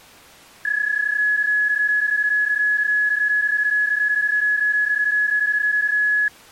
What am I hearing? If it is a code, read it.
PSK31 (31.25 baud), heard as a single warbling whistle, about 1700 Hz.